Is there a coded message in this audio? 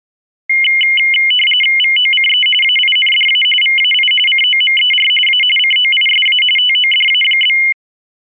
Yes: RTTY (45.45 baud, 850 Hz shift) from 0.5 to 7.7 s, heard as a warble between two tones, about 2550 Hz centre. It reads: VOCE AINDA VAI COMER A COISA TODA?